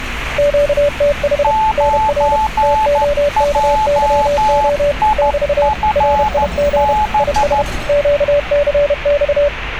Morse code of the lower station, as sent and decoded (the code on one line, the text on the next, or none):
--.- - .... / -. .-. / - --- -.- -.-- --- / -...- / .-. .. --. / .. ... / --.- -.-. -..-
QTH NR TOKYO <BT> RIG IS QCX